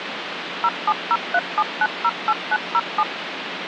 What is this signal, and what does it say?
DTMF, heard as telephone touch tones, dialled by machine, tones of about 50 ms, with phone line noise. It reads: 07037908907